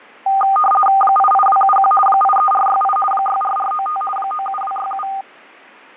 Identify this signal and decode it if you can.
RTTY (50 baud, 450 Hz shift), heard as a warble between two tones, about 1000 Hz centre, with fading. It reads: 88271 83468 64495 97267